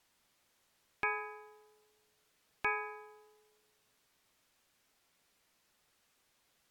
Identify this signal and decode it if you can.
Clock strike, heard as a bell. 2. Two o'clock.